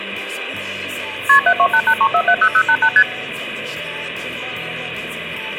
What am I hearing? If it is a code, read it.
Multi-frequency trunk signalling (R1, as on North American trunks), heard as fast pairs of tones, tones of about 70 ms. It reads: KP 72883470088 ST